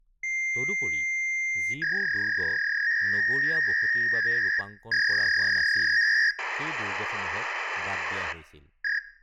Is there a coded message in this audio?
Yes: fax machine handshake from 0.2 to 9.0 s, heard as a long tone, a warble and hiss, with speech in Assamese.